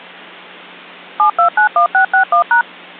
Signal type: DTMF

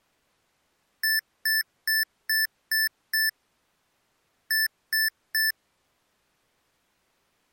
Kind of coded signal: beep code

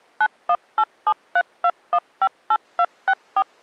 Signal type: DTMF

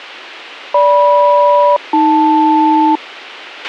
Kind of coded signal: aircraft SELCAL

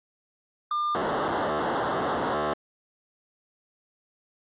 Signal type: POCSAG pager data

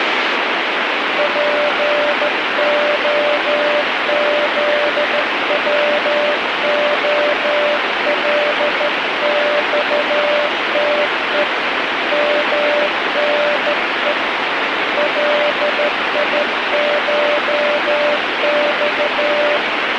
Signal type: Morse code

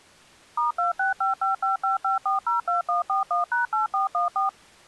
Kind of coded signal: DTMF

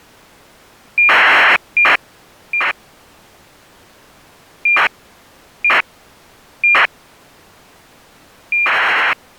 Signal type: ACARS aircraft data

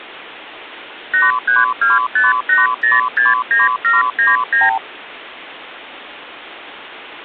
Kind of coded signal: multi-frequency trunk signalling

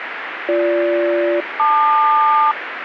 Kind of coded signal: aircraft SELCAL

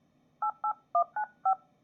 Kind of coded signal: DTMF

